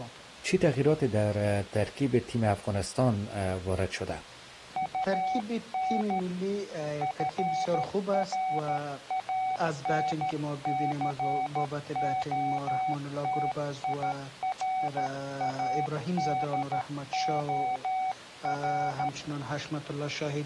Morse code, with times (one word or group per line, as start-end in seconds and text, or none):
4.8-6.2 UN
7.0-19.1 FRANCOTIRADOR